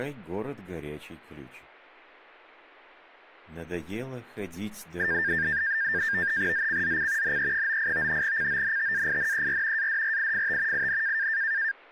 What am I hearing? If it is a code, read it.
NAVTEX (SITOR-B), 100 baud, 170 Hz shift, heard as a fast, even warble, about 1700 Hz centre. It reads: ZCZC NE98 CONTAINER ADRIFT IN